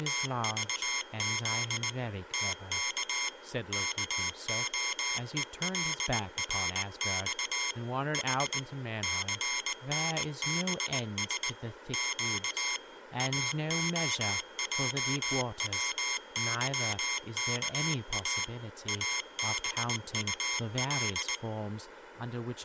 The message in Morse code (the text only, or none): … TK KOELRX H CNBS Q AOJWYKA ABUL